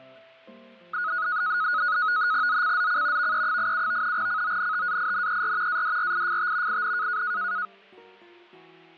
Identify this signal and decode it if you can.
NAVTEX (SITOR-B), 100 baud, 170 Hz shift, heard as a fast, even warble, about 1360 Hz centre. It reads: ZCZC VE87 CONTAINER ADRIFT IN